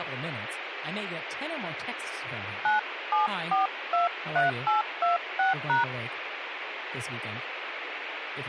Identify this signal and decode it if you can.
DTMF, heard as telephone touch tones, dialled by hand, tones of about 140 ms, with radio hiss and speech in English. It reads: 97423826#